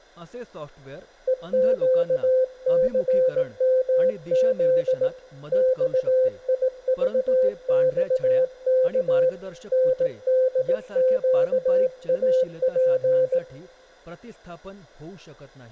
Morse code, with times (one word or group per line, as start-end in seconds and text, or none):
1.3-5.1 EQCMZ
5.5-9.3 XIVXK
9.7-13.4 NDQAP